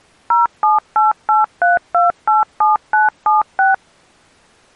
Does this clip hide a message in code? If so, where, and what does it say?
Yes: DTMF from 0.3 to 3.7 s, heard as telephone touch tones, dialled by machine, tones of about 160 ms. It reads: 07883287976